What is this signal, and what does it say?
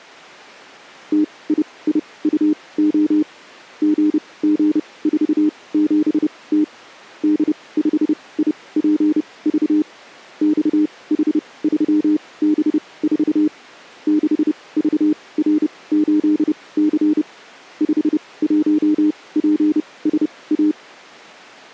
Morse code, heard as a keyed tone, machine-sent, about 30 wpm, spaced as for 21 wpm, 300 Hz. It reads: TIIUO GG47T D5IPV XH3B4 6VR8C 51PSA